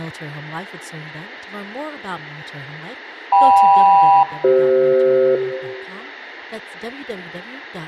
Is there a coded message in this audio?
Yes: aircraft SELCAL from 3.3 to 5.4 s, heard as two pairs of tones, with room echo and speech in English. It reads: KM-CF